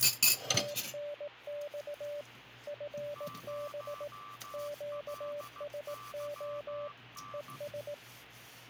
Morse code, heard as two keyed tones, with radio static and kitchen noise. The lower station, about 18 wpm, 580 Hz: TNX FB QSO ES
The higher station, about 15 wpm, 1170 Hz: 0LYN